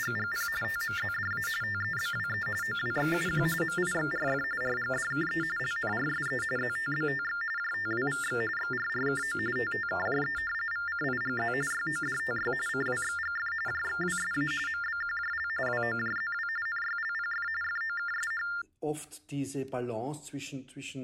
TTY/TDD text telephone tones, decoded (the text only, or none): … TMZDA TEBWE OWXUQ MIXRF RGDKE LNRSE ZTBTX JTWVX XRRKO TTKJE VCIGZ YODTY CWXGF JXWSA MBQJL WOJZW NYLPF FOKSH